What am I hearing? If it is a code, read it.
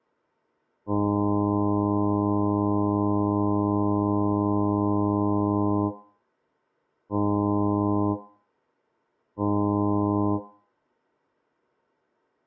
Ship horn signal, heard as a ship's horn, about 100 Hz, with room echo. 1 long, 2 short. At sea: a vessel in fog that is sailing, fishing, towing or hampered.